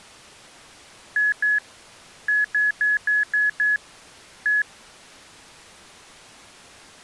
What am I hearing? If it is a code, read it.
Beep code, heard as beeps, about 1700 Hz. 2-6-1.